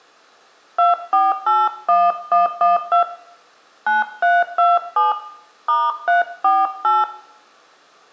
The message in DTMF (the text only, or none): 2481112 9327 *348